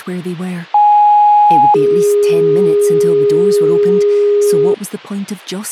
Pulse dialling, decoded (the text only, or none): none